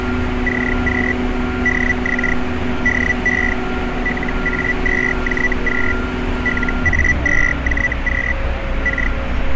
Hellschreiber (Feld-Hell, 122.5 baud), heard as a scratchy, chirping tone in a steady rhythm, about 1950 Hz, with radio static and street noise. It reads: CQ DX DE LA2JQ LA2JQ K